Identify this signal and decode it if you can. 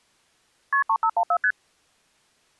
Multi-frequency trunk signalling (R1, as on North American trunks), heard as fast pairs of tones, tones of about 70 ms. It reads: KP 3514 ST